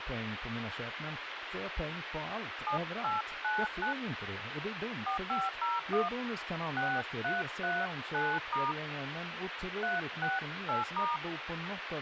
DTMF, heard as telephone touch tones, dialled by hand, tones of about 180 ms, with radio hiss and speech in Swedish. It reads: 7899 4501 6339* 368*